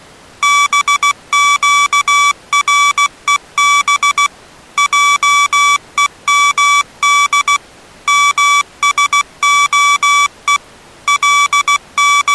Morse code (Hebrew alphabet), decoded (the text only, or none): בקרוב עומד משהו …